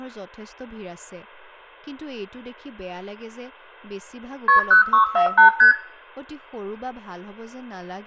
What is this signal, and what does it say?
Multi-frequency trunk signalling (R1, as on North American trunks), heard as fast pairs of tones, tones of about 110 ms, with room echo and speech in Assamese. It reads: KP 0648 ST